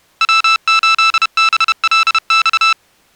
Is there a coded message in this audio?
Yes: Morse code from 0.2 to 2.8 s, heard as electronic beeps, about 31 wpm, 1320 Hz. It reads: W8BLX